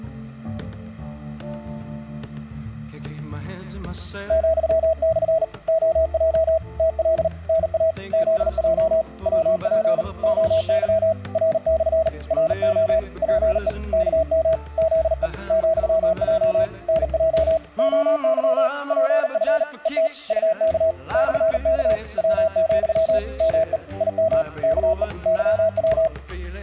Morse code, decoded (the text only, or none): ,/ OJ TL NA ZJ WP OY R/ RO PE KM ZE ,J NJ OY PF ET UK /K W, ME IM KE YW